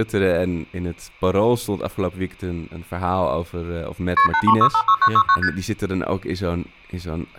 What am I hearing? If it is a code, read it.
Multi-frequency trunk signalling (R1, as on North American trunks), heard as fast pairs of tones, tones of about 70 ms, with room echo and speech in Dutch. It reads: KP 83656969 ST